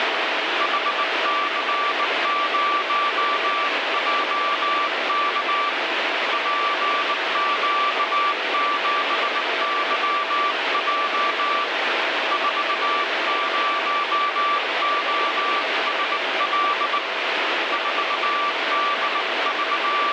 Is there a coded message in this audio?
Yes: Morse code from 0.5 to 20.1 s, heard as a keyed tone, hand-sent with a bug key, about 19 wpm, 1170 Hz, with heavy radio static. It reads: HC0JK PQ7YJ 40OSL …